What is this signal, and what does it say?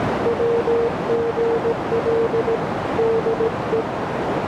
Morse code, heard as a keyed tone, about 17 wpm, 460 Hz, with heavy radio static and a narrow filter. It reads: WGL DE